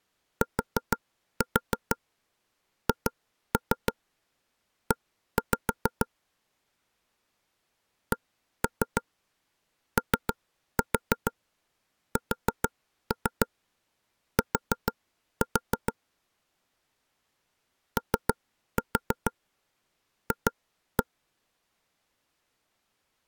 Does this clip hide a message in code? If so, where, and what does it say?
Yes: tap code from 0.4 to 21.0 s, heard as knocks on wood, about 6 knocks a second. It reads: THE COST OF